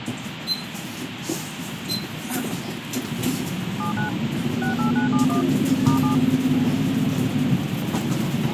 DTMF, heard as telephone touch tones, dialled by machine, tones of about 120 ms, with radio hiss and the noise inside a bus. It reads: 79 68971 *7